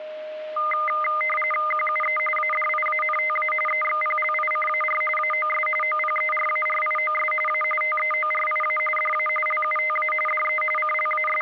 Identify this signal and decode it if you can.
RTTY (45.45 baud, 850 Hz shift), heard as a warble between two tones, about 1650 Hz centre, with a steady whistle near 620 Hz. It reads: QUE ADIANTA EXPLICAR AOS OPERARIOS A TEORIA DA LUTA DE …